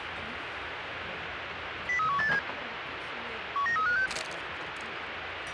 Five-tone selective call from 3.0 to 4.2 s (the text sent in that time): 19356